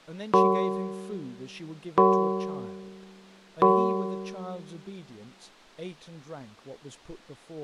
Clock strike, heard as a bell, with speech in English. 3. Three o'clock.